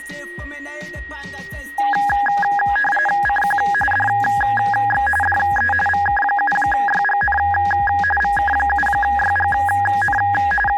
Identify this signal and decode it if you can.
RTTY (45.45 baud, 850 Hz shift), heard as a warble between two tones, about 1240 Hz centre, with a steady whistle near 1890 Hz. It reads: CQ DX DE VK7YGN VK7YGN …